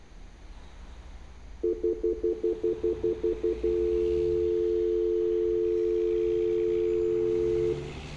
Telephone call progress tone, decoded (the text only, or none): stutter dial tone